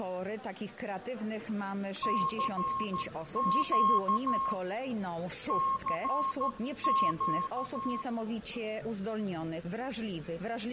Morse code, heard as a keyed tone, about 13 wpm, 1080 Hz, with fading and room echo. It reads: CQ CQ